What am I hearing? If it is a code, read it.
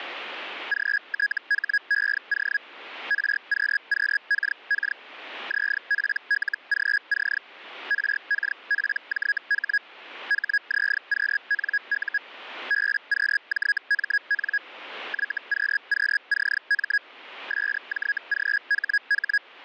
Hellschreiber (Feld-Hell, 122.5 baud), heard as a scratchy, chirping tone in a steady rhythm, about 1650 Hz. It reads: GTHEO RQQKK ZPLGC RKPJH HZQNU BQJMN YQQCM SJGHH